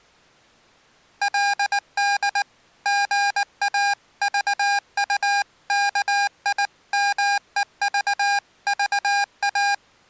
Morse code (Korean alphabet), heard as electronic beeps, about 19 wpm, 810 Hz. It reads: 그 소리야말로